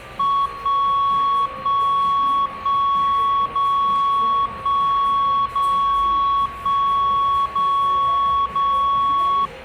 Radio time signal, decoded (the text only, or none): 1 1 1 0 1 0 1 0 0